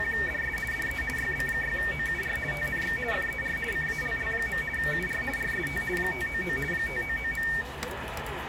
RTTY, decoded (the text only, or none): … DE YB6OUR TNX FER CALL. UR RST 599 599.